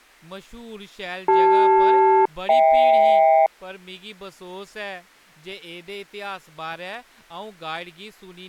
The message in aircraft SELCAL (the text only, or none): CL-HK